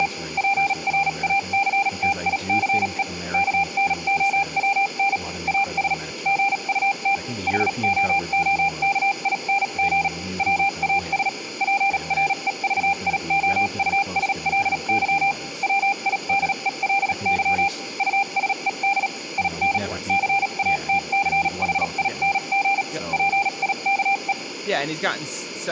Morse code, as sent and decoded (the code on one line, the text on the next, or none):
… / .--. .-. .- -.-. - .. -.-. . / -.- -. --- .-- -. / .- ... / --. ..- - / .... --- --- -.- .. -. --. / .-- .- ... / .--. .-. . ...- .. --- ..- ... .-.. -.-- / .-- .. -.. . .-.. -.-- / ..- ... . -.. / .. -. / -.-. .- - -.-. .... .. -. --. / .--. .. -.- .
… PRACTICE KNOWN AS GUT HOOKING WAS PREVIOUSLY WIDELY USED IN CATCHING PIKE